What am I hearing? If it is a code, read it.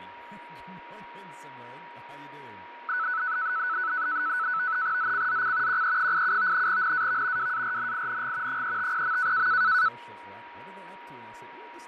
NAVTEX (SITOR-B), 100 baud, 170 Hz shift, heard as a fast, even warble, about 1400 Hz centre, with radio static, fading and a steady whistle near 950 Hz. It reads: ZCZC QE87 NAV WARNING 350.